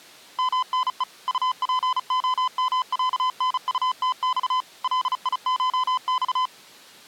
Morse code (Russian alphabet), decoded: МНЕ УПОМЯНУТЬ ЛИШЬ

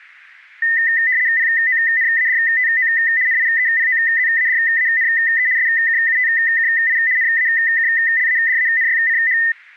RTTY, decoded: PONADTO NIEPOZADANE SKUTKI NAKLADANYCH

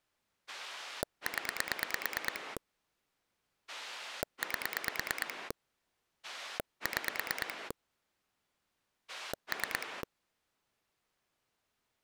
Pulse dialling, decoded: 0 8 6 3

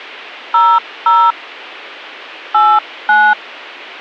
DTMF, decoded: 00 89

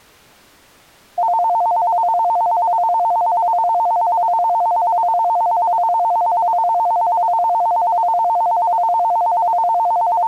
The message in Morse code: none

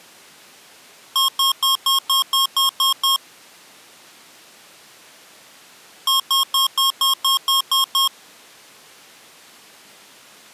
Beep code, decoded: 9 short

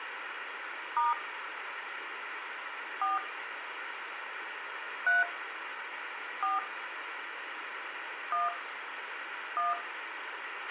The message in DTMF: * 4 3 4 1 1

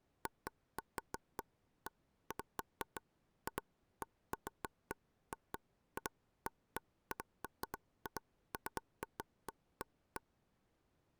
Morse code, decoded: none

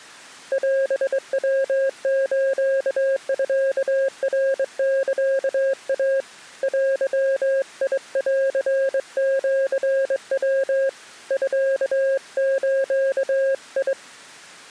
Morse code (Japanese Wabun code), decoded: オヤスミナサイ デンシヤ ミズ

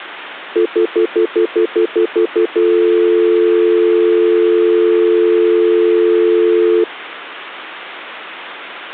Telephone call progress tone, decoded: stutter dial tone

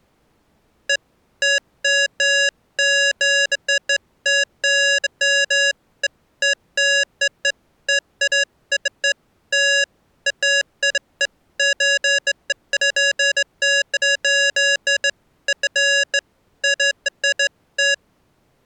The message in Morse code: none

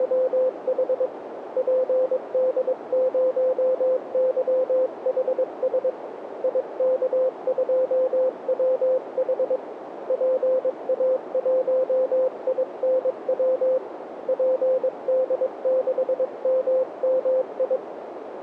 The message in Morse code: … PD0YHS IK2WH PA1INW PD6MMI

